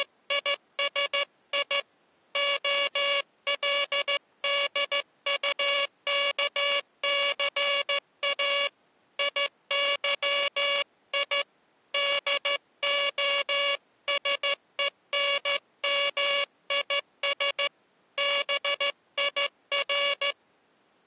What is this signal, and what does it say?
Morse code, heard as a buzzer, hand-sent with a straight key, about 14 wpm. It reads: … OLDUKCA IYI DOSENMIS BIR